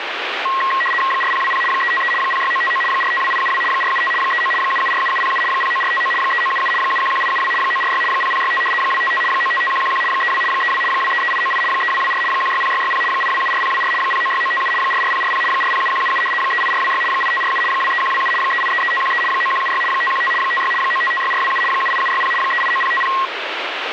RTTY (75 baud, 850 Hz shift), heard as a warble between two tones, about 1500 Hz centre, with radio static. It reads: 4020 353 06959 452872 475 39 7747707 09459 3977 711872 946 0065 255 955111 32 32 233898 3224 160660 8274024 096957 44040 407177 38426 8547 23127 3833513 9176 515 56 9556427 78760 389050